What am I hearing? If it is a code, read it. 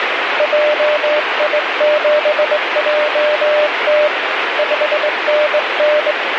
Morse code, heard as a keyed tone, hand-sent with a straight key, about 21 wpm, 600 Hz, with heavy radio static. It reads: JI7JT 5NN